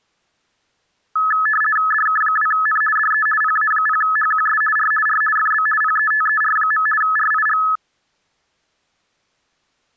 RTTY (50 baud, 450 Hz shift), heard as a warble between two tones, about 1500 Hz centre. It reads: DK2N DE PA0HQS R R FB PETER. RIG